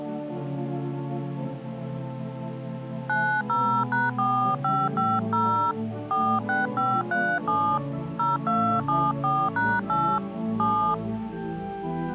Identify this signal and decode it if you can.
DTMF, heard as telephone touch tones, dialled by hand, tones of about 280 ms. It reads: 90#4550 46537 0274#8 7